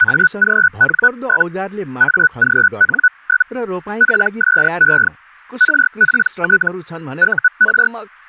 Hellschreiber (Feld-Hell, 122.5 baud), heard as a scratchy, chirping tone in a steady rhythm, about 1480 Hz, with speech in Nepali. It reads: AGN? AGN? PSE RPT UR